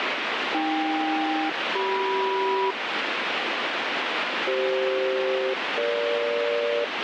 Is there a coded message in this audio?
Yes: aircraft SELCAL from 0.5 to 6.8 s, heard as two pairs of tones, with heavy radio static. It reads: AK-CM CF-EG